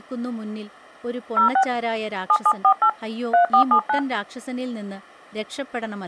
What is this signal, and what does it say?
DTMF, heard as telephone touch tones, dialled by hand, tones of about 90 ms, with speech in Malayalam. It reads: 06 7748 3479